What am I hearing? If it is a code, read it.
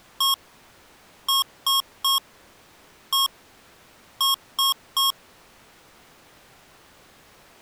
Beep code, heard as beeps from a small speaker, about 1090 Hz. 1-3-1-3. In Phoenix BIOS tables: keyboard controller test failure.